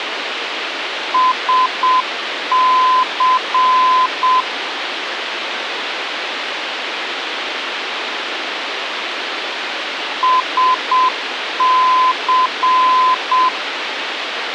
Morse code, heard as a keyed tone, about 7 wpm, 1020 Hz, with radio hiss and a squelch burst at the end. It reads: SC SC